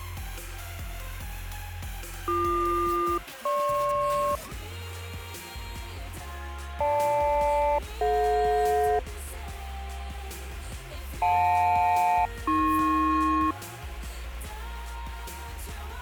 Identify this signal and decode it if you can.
Aircraft SELCAL, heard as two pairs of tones. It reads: BQ-GP GL-DJ JL-AP